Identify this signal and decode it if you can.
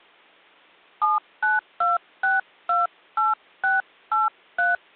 DTMF, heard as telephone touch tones, dialled by hand, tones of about 170 ms. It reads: 792628683